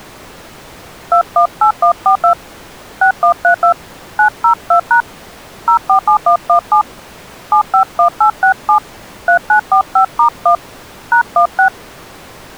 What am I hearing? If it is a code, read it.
DTMF, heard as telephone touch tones, dialled by hand, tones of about 100 ms. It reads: 218142 6132 902# 047117 751867 3945*1 #16